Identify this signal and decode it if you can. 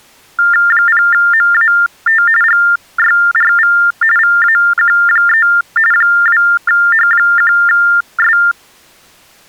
TTY/TDD text telephone tones (45.45 baud Baudot), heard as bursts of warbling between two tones, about 400 Hz shift, 1600 Hz centre. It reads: 0MAT GYRV VAQ3 2H1S